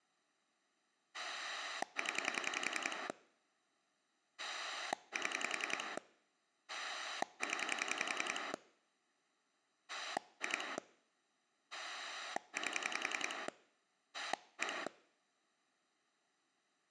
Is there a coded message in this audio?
Yes: pulse dialling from 1.1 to 14.9 s, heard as a rotary dial, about 10 pulses a second. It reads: 0 7 0 2 8 1